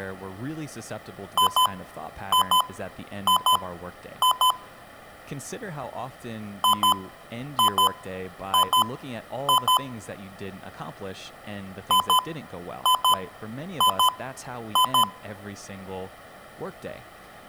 Beep code, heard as beeps from a small speaker, played three times, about 1010 Hz, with room echo and speech in English. 2-2-2-2.